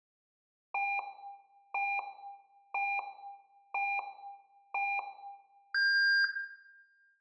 Radio time signal (five pips and a higher one, as on Chinese radio), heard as pips, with room echo.